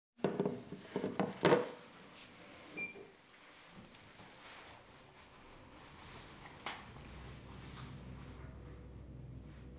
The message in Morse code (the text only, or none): none